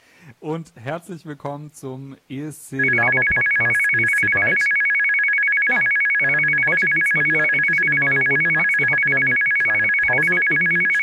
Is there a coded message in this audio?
No, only a tone that alternates evenly between two pitches.